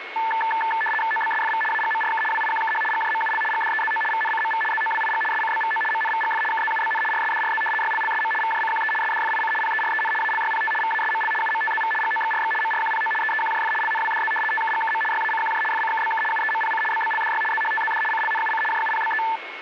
RTTY (75 baud, 850 Hz shift), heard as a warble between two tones, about 1320 Hz centre, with radio static and a steady whistle near 2180 Hz. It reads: OBSFV AGMRK WIQKH GJMUL GDEZO VNCMV ZOWIG SCBVO MNVGF KZUBN RSDRZ YLLSM VJCQE SDFIC PEREN ALYPT VASML UMTZV GOXRX MRQPO EEQJF LNWDZ TKGKM YACQJ FCKBK UEMPC BBLDY ZHTZD CLNUC JUPBE